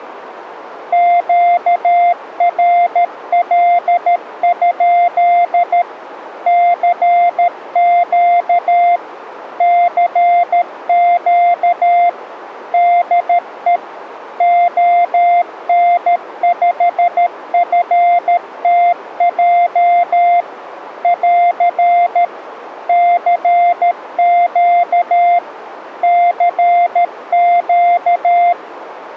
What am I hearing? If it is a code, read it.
Morse code, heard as a keyed tone, machine-sent, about 13 wpm, 700 Hz. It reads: QRL? CQ CQ DE ON5FTJ <AR> CQ CQ